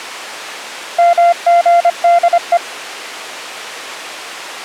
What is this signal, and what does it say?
Morse code (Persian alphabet), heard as a keyed tone, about 25 wpm, 690 Hz. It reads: مژده